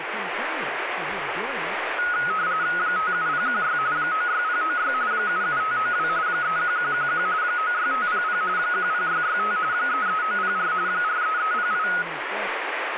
RTTY (45.45 baud, 170 Hz shift), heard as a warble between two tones, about 1360 Hz centre, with radio static. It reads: 57016 96096 77592 31111 96500 10665 33904 43308